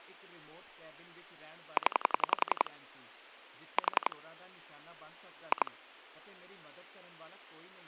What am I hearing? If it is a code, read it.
Pulse dialling, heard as clicks on a phone line, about 11 pulses a second, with speech in Punjabi. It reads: 0 4 2